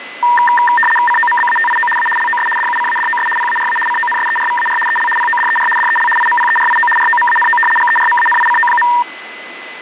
RTTY (75 baud, 850 Hz shift), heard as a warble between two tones, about 1390 Hz centre, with radio static and a steady whistle near 2020 Hz. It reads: COMBATIO A LOS DUCADOS PARA CONSERVAR EL PODER DEL IMPERIO ROMANO GERMANICO.